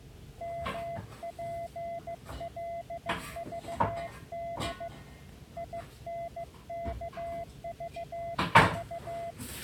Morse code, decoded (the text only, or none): MPLVD INKVV